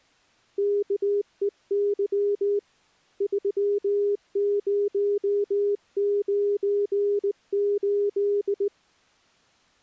Morse code, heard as a keyed tone, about 18 wpm, 410 Hz. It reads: KEY 3098